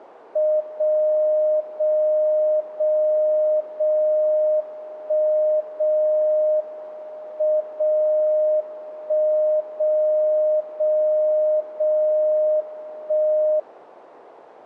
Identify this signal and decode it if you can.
Radio time signal (WWVB), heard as a tone whose level steps once a second, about 610 Hz. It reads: 0 0 0 0 1 0 M 0 1 0 0 0 1